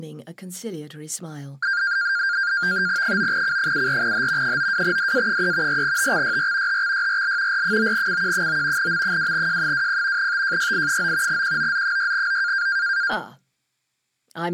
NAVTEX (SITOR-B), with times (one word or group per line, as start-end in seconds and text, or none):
3.0-4.6 9C74H
4.4-5.8 92DA3
5.7-6.8 4TXYR
6.7-7.6 HXYRL
7.5-8.9 R9CQ9
8.8-10.3 M2J20
10.2-11.4 TJYI9
11.3-12.7 QOZ6O